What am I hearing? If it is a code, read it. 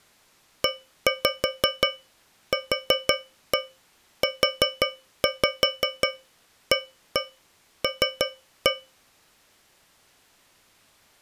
Tap code, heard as taps on a metal pipe, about 5 knocks a second. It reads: EQUAL